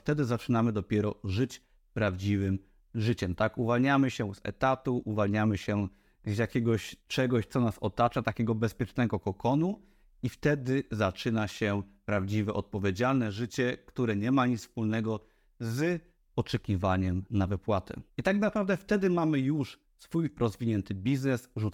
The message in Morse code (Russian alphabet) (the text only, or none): none